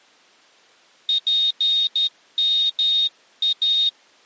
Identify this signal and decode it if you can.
Morse code (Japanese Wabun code), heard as a high beeper, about 12 wpm, 3700 Hz. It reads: ツヨイ